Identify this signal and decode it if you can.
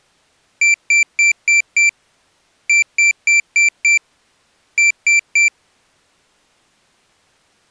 Beep code, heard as a piezo beeper, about 2350 Hz. 5-5-3.